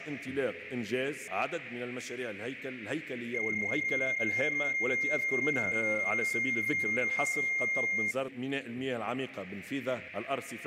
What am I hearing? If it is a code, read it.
PSK31 (31.25 baud), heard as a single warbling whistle, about 2100 Hz.